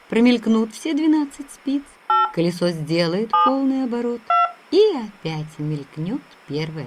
DTMF, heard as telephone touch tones, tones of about 150 ms. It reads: 8 7 2